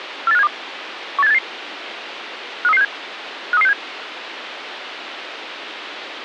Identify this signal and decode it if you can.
Five-tone selective call (EEA), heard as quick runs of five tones, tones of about 40 ms, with radio hiss. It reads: 48572 18788 53367 53367